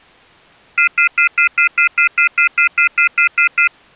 Telephone call progress tone (North American plan), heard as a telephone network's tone, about 1400, 2050, 2450, 2600 Hz, 0.1 s on and 0.1 s off. Off-hook warning tone.